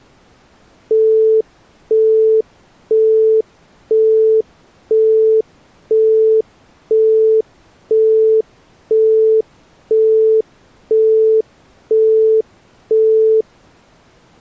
Telephone call progress tone (single-tone plan, as in Europe, Japan and elsewhere), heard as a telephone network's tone, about 440 Hz, 0.5 s on and 0.5 s off. Busy tone.